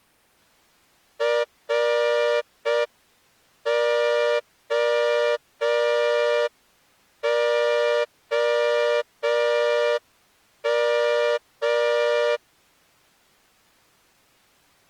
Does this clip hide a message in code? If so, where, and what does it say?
Yes: Morse code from 1.1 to 12.4 s, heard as a horn, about 5 wpm. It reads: ROOM